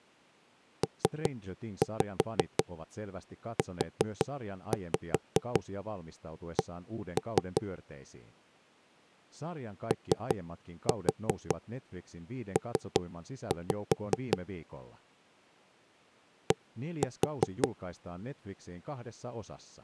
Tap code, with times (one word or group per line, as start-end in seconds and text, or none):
0.8-7.6 PUC
9.9-14.4 OP
16.5-17.7 D